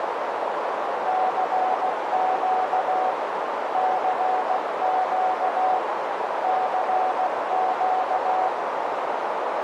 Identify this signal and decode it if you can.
Morse code, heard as a keyed tone, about 16 wpm, 750 Hz, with heavy radio static and a narrow filter. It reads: CQ CQ CQ